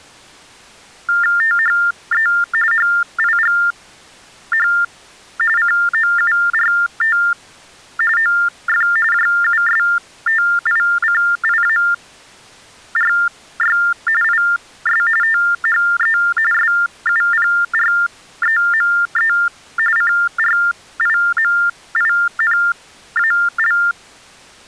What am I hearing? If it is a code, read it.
TTY/TDD text telephone tones (45.45 baud Baudot), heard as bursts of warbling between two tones, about 400 Hz shift, 1600 Hz centre. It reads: THE HIGH COURT OF JUSTICIARY IS THE SUPREME CRIMINAL